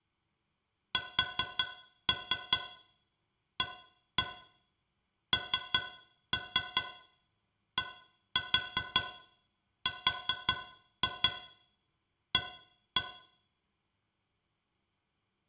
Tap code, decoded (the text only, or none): SANDRA